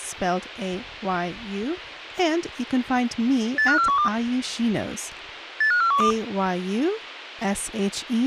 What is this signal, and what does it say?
Five-tone selective call (CCIR), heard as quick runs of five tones, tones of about 100 ms, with speech in English. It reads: 85412 85412